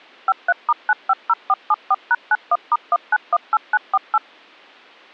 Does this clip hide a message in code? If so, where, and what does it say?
Yes: DTMF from 0.3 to 4.2 s, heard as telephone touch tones, dialled by machine, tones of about 40 ms. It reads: 53*950474#91*1918948